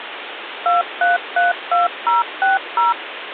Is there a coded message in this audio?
Yes: DTMF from 0.7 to 2.9 s, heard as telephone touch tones, dialled by machine, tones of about 160 ms, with phone line noise. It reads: 2332060